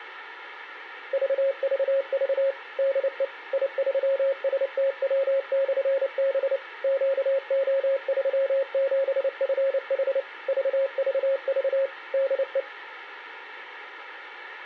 Morse code, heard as a keyed tone, machine-sent, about 29 wpm, 540 Hz. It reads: VVV DE I3STW/B QO37FH VVV DE